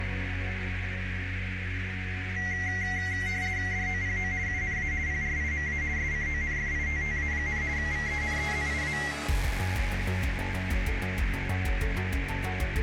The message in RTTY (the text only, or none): DOPO UNA PRIMA SCONFITTA, VENEZIA